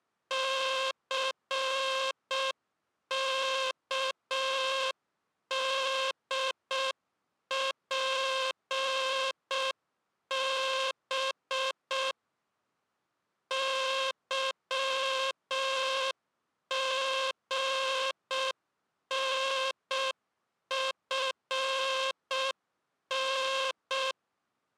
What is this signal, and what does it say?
Morse code, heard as a buzzer, machine-sent, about 6 wpm. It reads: CKDPB YGNFN